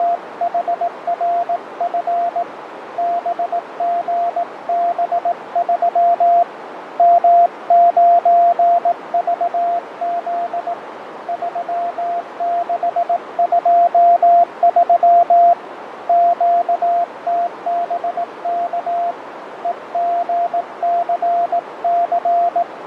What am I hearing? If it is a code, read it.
Morse code, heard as a keyed tone, hand-sent with a bug key, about 18 wpm, 690 Hz, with radio static, fading and a narrow filter. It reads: … BGB3 M9VZ 3623 QTBK EGCC